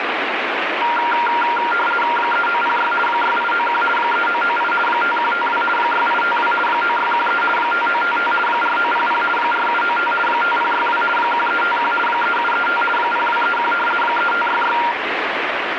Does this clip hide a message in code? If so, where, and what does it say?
Yes: RTTY (50 baud, 450 Hz shift) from 0.8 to 14.9 s, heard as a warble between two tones, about 1170 Hz centre, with radio static. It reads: 3906 6891 3998 5152 6852 9613 5955 4900 4795 5062 1351 3735 0231 3566